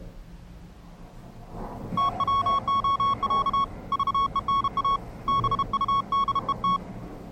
Morse code (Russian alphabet), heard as a keyed tone, hand-sent with a bug key, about 32 wpm, 1110 Hz, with the noise inside a lift. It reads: ТВОЯ ЖЕНА БУДЕТ